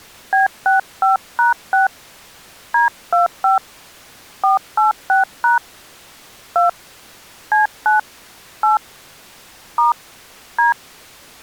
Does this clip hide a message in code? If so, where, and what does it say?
Yes: DTMF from 0.3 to 10.7 s, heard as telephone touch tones, dialled by hand, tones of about 140 ms. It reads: B65#6 D25 486# 2 C9 8 * D